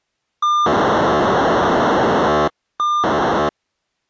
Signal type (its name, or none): POCSAG pager data